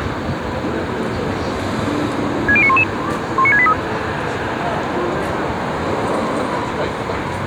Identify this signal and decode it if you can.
Five-tone selective call (ZVEI), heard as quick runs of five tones, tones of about 70 ms, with street noise. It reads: 60911 19683